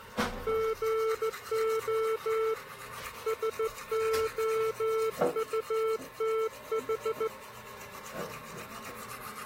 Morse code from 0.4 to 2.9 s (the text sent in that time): GO